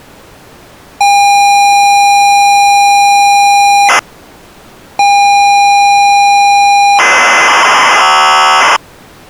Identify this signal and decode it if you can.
ZX Spectrum tape loading, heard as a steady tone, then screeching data.